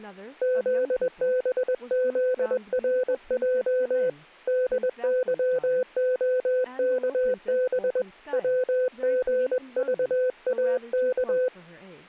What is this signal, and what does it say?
Morse code, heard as a keyed tone, hand-sent with a paddle, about 21 wpm, 510 Hz, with speech in English. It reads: ZBZRJ DYOKB WGVAK